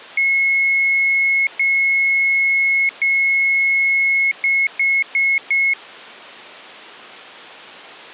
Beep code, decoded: 3 long, 4 short

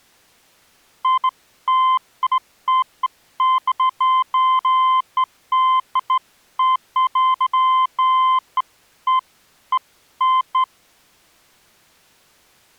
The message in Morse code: none

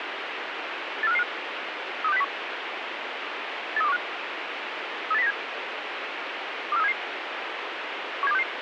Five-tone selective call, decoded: 84555 32601 83215 38097 24377 17266

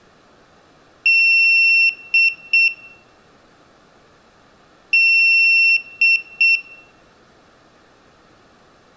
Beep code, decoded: 1 long, 2 short

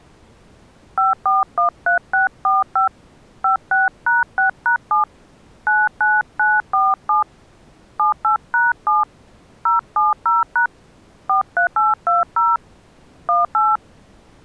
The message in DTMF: 5413645 56#6#7 99947 78#7 070# 43820 18

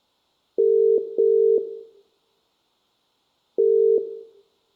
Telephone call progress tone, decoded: ringback tone

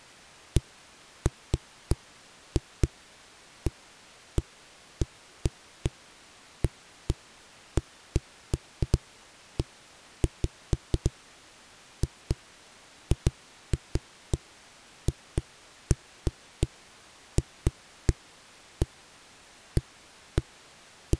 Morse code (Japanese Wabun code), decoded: none

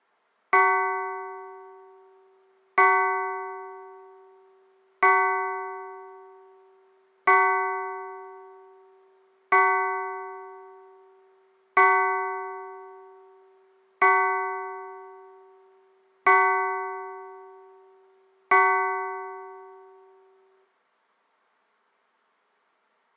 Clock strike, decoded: 9

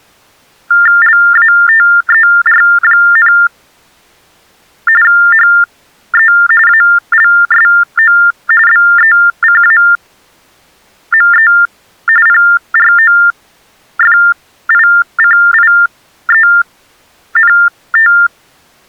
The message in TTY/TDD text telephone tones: LATER, HE ALSO BECAME PROFICIENT

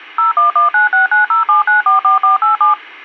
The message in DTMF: 01196907944487

